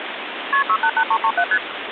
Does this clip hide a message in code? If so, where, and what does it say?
Yes: multi-frequency trunk signalling (R1, as on North American trunks) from 0.5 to 1.6 s, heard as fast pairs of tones, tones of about 70 ms, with phone line noise. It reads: KP 688337 ST